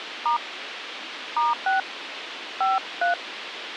DTMF, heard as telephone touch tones, dialled by hand, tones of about 140 ms, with radio hiss. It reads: * *6 53